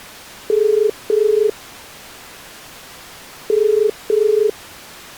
Telephone call progress tone (as in the UK, Ireland, Australia and similar networks), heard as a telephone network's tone, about 430 Hz. Ringback tone.